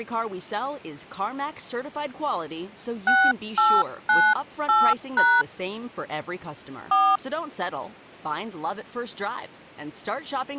DTMF, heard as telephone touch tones, dialled by hand, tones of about 250 ms, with speech in English. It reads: 6898# 4